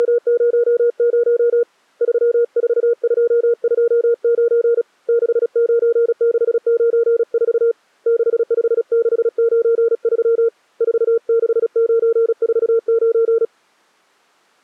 Morse code, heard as a keyed tone, hand-sent with a paddle, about 36 wpm, 470 Hz. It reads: … 34229 69694 65693 46949